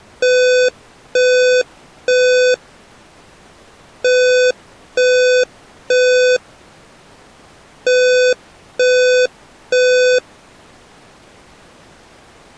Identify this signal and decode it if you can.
Alarm pattern, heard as an alarm's beeps, played three times, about 500 Hz. Temporal three. Smoke or fire, evacuate.